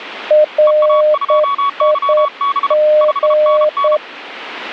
Morse code, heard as two keyed tones. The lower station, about 9 wpm, 610 Hz: RIG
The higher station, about 33 wpm, 1120 Hz: EA2YB 5NN